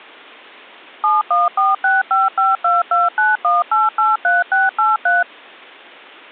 DTMF, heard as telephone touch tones, dialled by machine, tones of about 180 ms. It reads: 7146552291883683